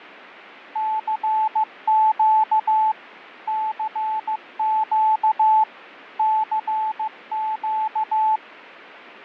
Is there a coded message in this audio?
Yes: Morse code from 0.7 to 8.4 s, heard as a keyed tone, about 15 wpm, 870 Hz, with fading. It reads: CQ CQ CQ